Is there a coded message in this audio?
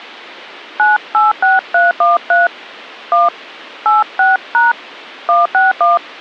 Yes: DTMF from 0.8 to 6.0 s, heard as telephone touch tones, dialled by hand, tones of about 170 ms. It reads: 986313 1 86# 161